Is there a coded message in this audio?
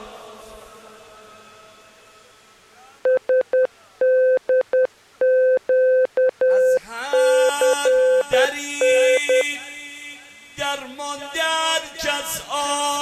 Yes: Morse code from 3.0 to 9.5 s, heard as a keyed tone, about 10 wpm, 510 Hz. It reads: SDQCN